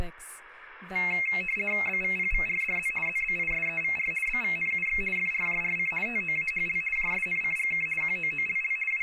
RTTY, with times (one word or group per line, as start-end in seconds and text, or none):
1.9-2.9 BVPVRDZ
3.1-4.1 ZBISEVR
4.3-5.0 BVNUX
5.2-5.9 FRJRC
6.1-6.8 TOAHL
7.0-7.9 JSNCGK
8.0-8.8 QOOLL
8.9-9.0 …